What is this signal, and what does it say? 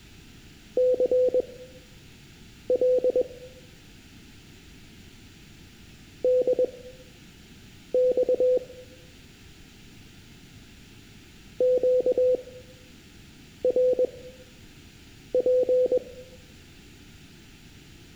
Morse code, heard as a keyed tone, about 21 wpm, spaced as for 6 wpm, 500 Hz, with room echo. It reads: CL DX QRP